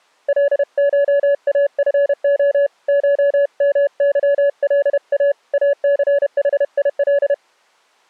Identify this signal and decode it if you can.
Morse code (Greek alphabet), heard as a keyed tone, hand-sent with a paddle, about 31 wpm, 570 Hz. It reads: ΛΧΑΦΟ ΧΜΥΛΑ ΑΘΗΙΛ